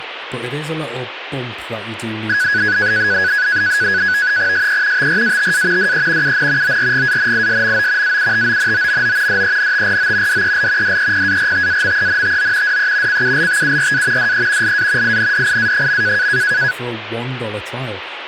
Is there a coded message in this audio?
Yes: NAVTEX (SITOR-B), 100 baud, 170 Hz shift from 2.3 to 16.7 s, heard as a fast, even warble, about 1600 Hz centre, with radio static and speech in English. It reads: SE TRATA DE UN ORGANISMO AUTONOMO DENTRO DEL DEPARTAMENTO DE CULTURA DE LA INDIA.